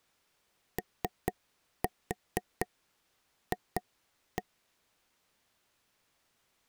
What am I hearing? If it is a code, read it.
Tap code, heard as taps on a table, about 4 knocks a second. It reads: OF